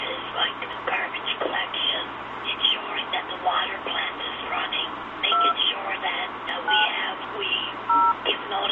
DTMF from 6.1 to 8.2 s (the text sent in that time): 9 0